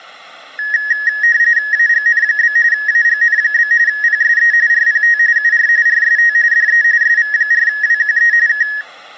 RTTY (45.45 baud, 170 Hz shift), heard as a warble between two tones, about 1800 Hz centre. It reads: AGN? AGN? PSE RPT UR RST DE SV4WQE K